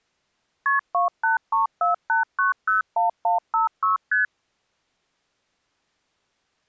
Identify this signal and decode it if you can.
Multi-frequency trunk signalling (R1, as on North American trunks), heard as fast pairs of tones, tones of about 140 ms. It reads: KP 28348901156 ST